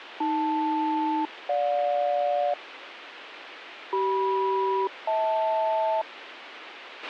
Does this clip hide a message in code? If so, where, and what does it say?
Yes: aircraft SELCAL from 0.2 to 6.0 s, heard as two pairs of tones, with radio hiss and a squelch burst at the end. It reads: AL-GJ CM-HL